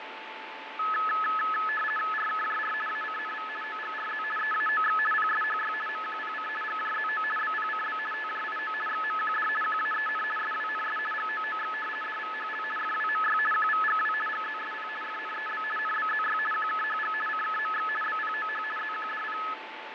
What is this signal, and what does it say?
RTTY (50 baud, 450 Hz shift), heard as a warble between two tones, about 1500 Hz centre, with radio static, fading and a steady whistle near 880 Hz. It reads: RKJR ACNV OGRZ EAOX PSHY MQPC GJZO BPCB TJIO XMQD QAEN SWNS GOOX DVHL FWMY QVGW GZSP FNEB NBZY QKHG CKMX BPOH ZQDP